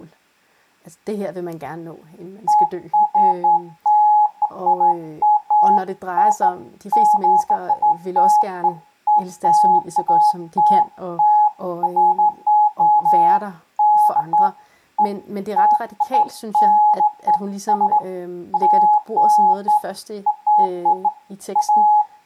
Beeps of irregular length, with speech in Danish. There is no code.